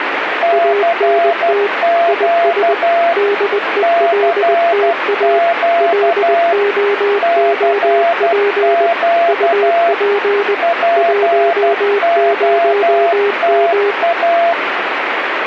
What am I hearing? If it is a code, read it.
Morse code, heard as two keyed tones, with radio static. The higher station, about 12 wpm, 680 Hz: CQ CQ CQ POTA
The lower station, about 20 wpm, 410 Hz: ANT IS DELTA LOOP UP 10M